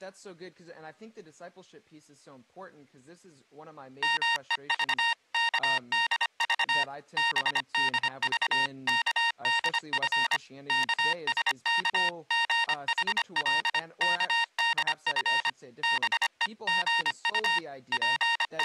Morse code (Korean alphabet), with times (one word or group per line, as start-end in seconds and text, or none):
4.0-6.8 말을
7.2-10.4 들은
10.7-15.5 영숙은
15.8-17.6 다시
17.9-18.6 …